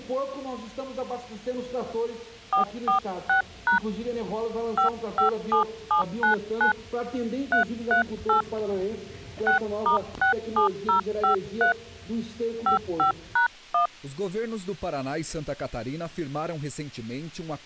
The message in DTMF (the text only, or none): 446# 557799 338 6*67053 55#1